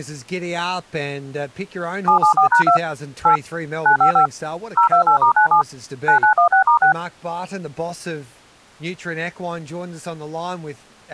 DTMF, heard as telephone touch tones, dialled by machine, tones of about 100 ms, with speech in English. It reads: 774#2 8 955 028*97 9916*6